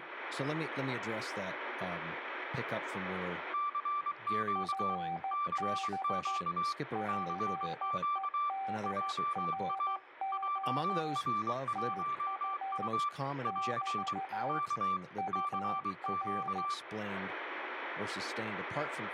Morse code, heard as two keyed tones, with radio static and speech in English. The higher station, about 23 wpm, 1170 Hz: CQ CQ CQ JA JR1U <AR> K CQ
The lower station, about 14 wpm, 780 Hz: FB PEDRO TU <BT> UR